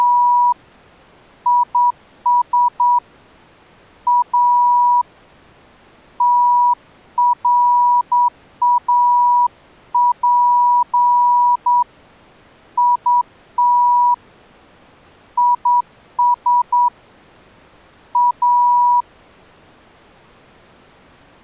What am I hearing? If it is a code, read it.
Morse code, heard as a keyed tone, hand-sent with a straight key, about 9 wpm, 970 Hz. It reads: … IS A TRAP IT IS A